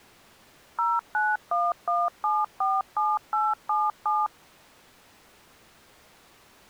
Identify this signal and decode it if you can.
DTMF, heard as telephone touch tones, dialled by machine, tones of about 210 ms. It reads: 0911747877